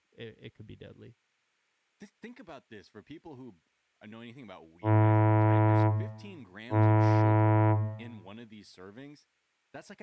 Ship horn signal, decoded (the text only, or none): 2 short